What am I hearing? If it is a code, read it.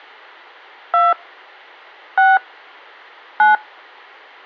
DTMF, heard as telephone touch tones, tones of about 200 ms. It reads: 2 6 9